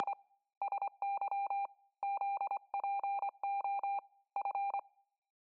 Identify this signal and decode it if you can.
Morse code (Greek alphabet), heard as a keyed tone, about 25 wpm, 800 Hz, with room echo. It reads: … ΣΥ ΖΠΟ Φ